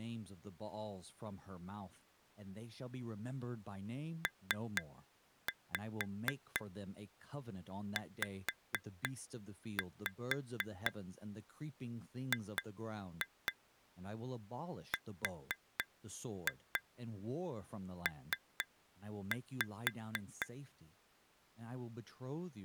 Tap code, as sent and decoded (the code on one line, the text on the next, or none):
3-5 5-5 2-2 4-2 3-5
PZGRP